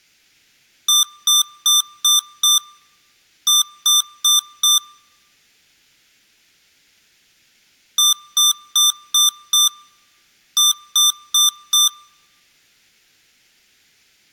Beep code, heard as beeps from a small speaker, played twice, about 1190 Hz, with room echo. 5-4.